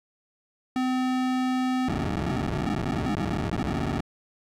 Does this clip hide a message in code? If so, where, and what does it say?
Yes: POCSAG pager data (512 baud) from 0.8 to 4.0 s, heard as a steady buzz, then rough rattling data.